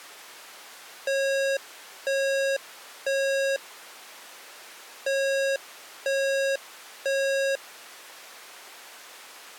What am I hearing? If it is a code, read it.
Alarm pattern, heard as an alarm's beeps, played twice, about 550 Hz. Temporal three. Smoke or fire, evacuate.